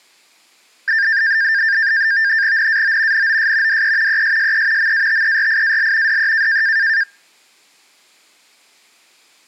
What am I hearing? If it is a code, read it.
NAVTEX (SITOR-B), 100 baud, 170 Hz shift, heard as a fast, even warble, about 1700 Hz centre. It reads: NAO NOS DE ESSE MATERIAL DE